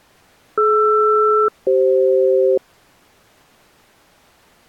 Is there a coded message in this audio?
Yes: aircraft SELCAL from 0.6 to 2.6 s, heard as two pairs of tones. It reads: DR-CF